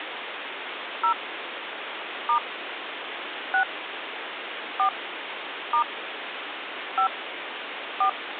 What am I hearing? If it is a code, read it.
DTMF, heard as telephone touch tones, dialled by hand, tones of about 90 ms, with phone line noise. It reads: 0 * 6 4 * 5 4